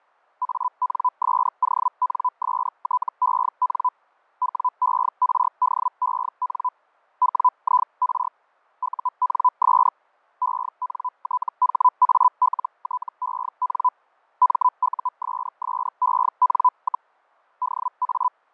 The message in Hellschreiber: ANSONSTEN WERDEN WIR UNS ENTHALTEN MUSSEN, DA

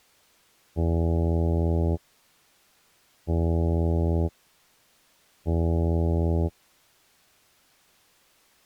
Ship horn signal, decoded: 3 short

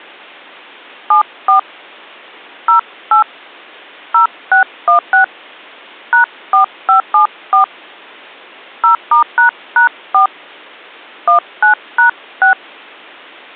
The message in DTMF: 74 08 0616 #4574 0*##4 19#6

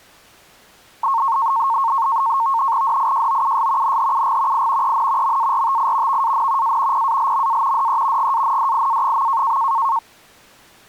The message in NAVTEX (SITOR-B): DIJOUS NHUG I EN MARTI VAN A PALMA DE GANDIA.

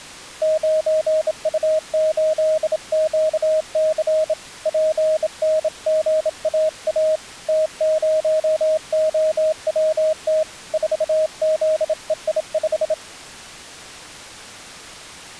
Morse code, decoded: 9U8QC PNGAA T0OWT 4ZEI5

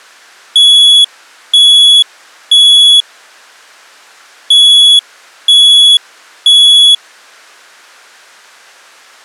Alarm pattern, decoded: temporal three

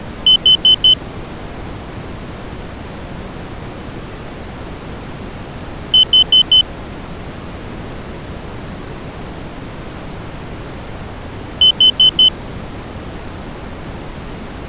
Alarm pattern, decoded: temporal four

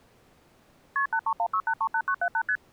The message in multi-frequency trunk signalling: KP 8316838978 ST

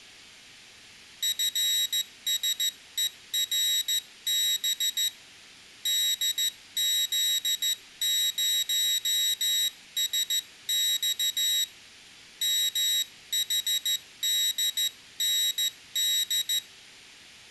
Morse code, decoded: FSERB DZ0SX MHDND

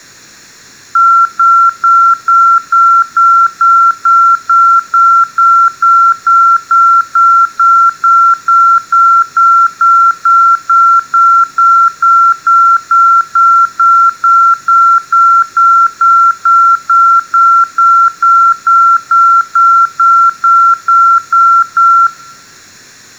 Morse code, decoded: none

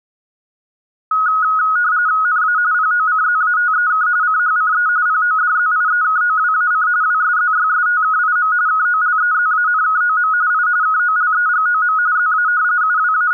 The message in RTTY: NA POCZATEK CHCE PODZIEKOWAC WSZYSTKIM KOLEZANKOM I KOLEGOM ZA …

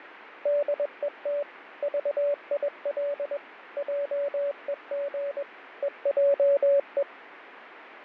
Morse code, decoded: DET VIL JEG EJE

